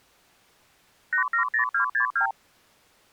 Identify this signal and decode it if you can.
Multi-frequency trunk signalling (R2, with the far end's replies), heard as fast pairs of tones, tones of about 100 ms. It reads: 870262